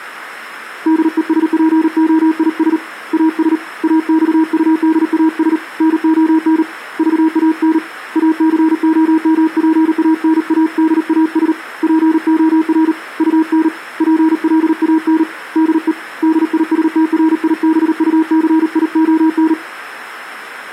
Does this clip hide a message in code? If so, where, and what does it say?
Yes: Morse code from 0.8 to 19.6 s, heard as a keyed tone, hand-sent with a paddle, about 38 wpm, 320 Hz. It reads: DESPOIS AS AXUDAS NON VAN ACOMPANADAS POR UN PLAN DE DISTRIBUCION